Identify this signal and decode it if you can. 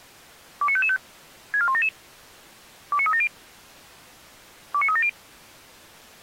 Five-tone selective call (ZVEI), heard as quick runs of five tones, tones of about 70 ms. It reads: 29555 64177 29370 29370